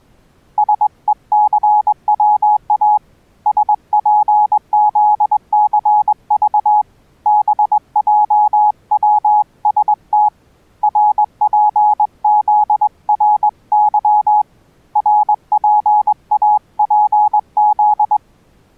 Morse code, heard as a keyed tone, hand-sent with a straight key, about 21 wpm, 840 Hz. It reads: SECWA SPZCV BJWST RPZRY RPAPZ